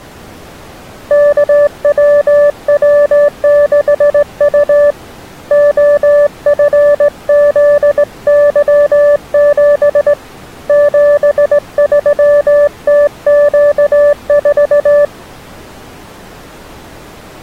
Morse code, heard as a keyed tone, hand-sent with a straight key, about 18 wpm, 580 Hz. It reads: KWW6U OFZY7 73TQ4